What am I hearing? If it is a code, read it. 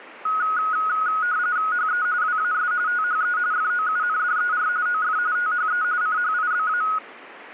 RTTY (45.45 baud, 170 Hz shift), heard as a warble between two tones, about 1360 Hz centre. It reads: HE WAS THE FOUNDER OF THE CHIBA